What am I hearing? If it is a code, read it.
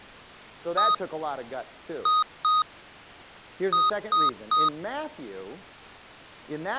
Beep code, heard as beeps from a small speaker, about 1250 Hz, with speech in English. 1-2-3. In Phoenix BIOS tables: DMA page register failure.